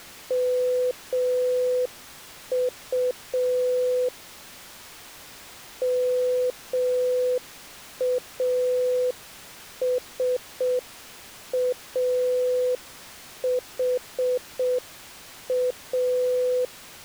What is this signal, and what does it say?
Morse code, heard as a keyed tone, hand-sent with a straight key, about 6 wpm, 500 Hz. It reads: MU MASAHA